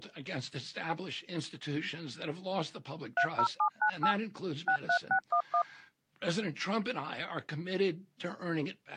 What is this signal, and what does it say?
DTMF, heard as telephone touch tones, dialled by machine, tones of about 80 ms. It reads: 30798 63611